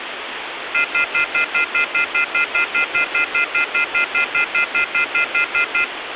Telephone call progress tone (North American plan), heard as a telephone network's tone, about 1400, 2050, 2450, 2600 Hz, 0.1 s on and 0.1 s off, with phone line noise. Off-hook warning tone.